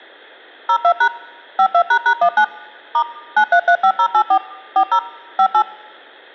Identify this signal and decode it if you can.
DTMF, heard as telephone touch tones, dialled by machine, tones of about 80 ms. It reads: 02# 52##19 * 9335084 40 58